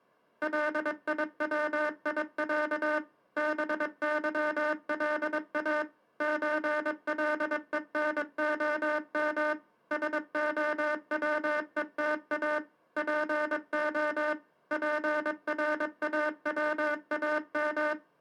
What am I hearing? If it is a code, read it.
Morse code (Russian alphabet), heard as a buzzer, machine-sent, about 22 wpm. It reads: ЛИВИЯ БЫЛА ЧЛЕНОМ СОВЕТА ПО ПРАВАМ